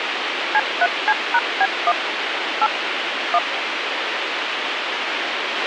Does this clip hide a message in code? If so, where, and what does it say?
Yes: DTMF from 0.5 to 3.4 s, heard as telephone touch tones, dialled by machine, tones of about 50 ms, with radio hiss and a squelch burst at the end. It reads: C3C#B1 8 1